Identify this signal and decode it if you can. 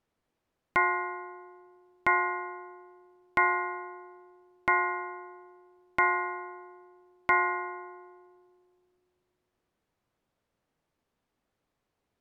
Clock strike, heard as a bell. 6. Six o'clock.